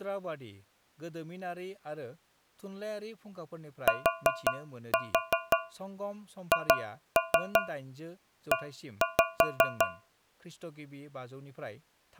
Tap code, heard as taps on a metal pipe, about 5 knocks a second, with speech in Bodo. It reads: THE